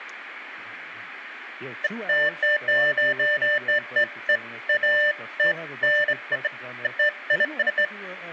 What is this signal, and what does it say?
Beeps of irregular length, with room echo and speech in English. There is no code.